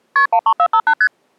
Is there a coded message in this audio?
Yes: multi-frequency trunk signalling (R1, as on North American trunks) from 0.2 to 1.1 s, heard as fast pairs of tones, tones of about 70 ms. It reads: KP 13458 ST